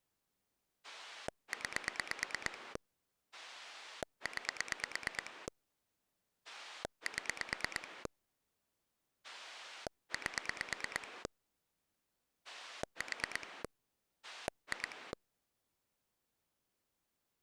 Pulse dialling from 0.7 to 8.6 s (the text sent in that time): 9 9 7